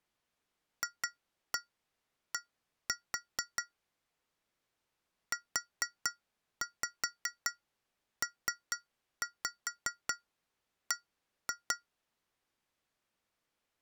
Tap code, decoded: FD UPB

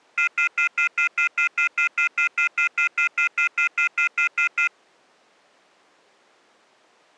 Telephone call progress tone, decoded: off-hook warning tone

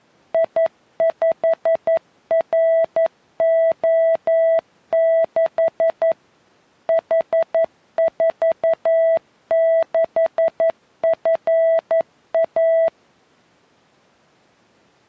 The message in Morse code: I5RO6 H46FA

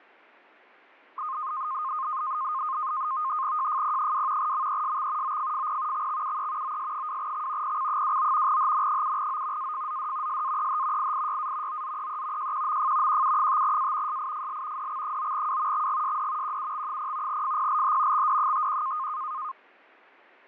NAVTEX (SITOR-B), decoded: JFP2 MESX OFFP XXUE OS2X PC29 HN7O AFZD SAEH IIYA OZEE JQMF QU5A SIFL DX9W XGSD QUX0 FPLH XD51

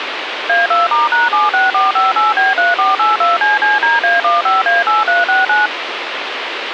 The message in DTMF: A2*#76458B3482CCDA15A8369

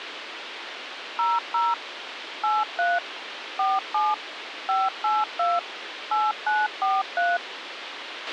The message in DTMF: 00 83 47 582 8943

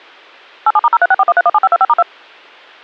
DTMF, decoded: 87*03641317525*2

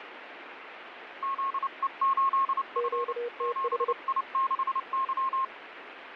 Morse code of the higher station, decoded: ZE8F 7I6Y

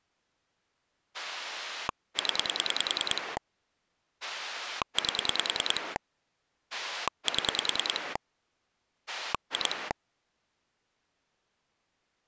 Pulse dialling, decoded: 0 8 7 2

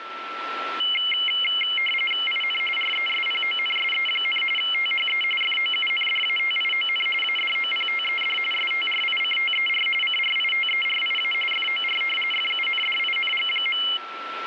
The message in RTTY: IN RESPONSE, THE FOUNDATION ADOPTED STRICTER CRITERIA FOR FUNDING.

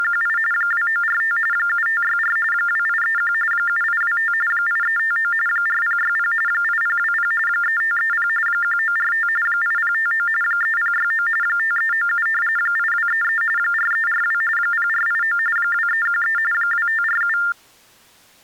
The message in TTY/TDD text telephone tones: … 2945 7564 2831 7825 8359 4060 8020 3530 1945 8059 3069 5397 8233 4342 0489 2313 2547

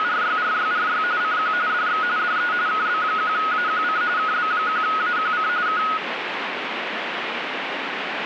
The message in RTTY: … CQ DX DE KB1AQC KB1AQC K

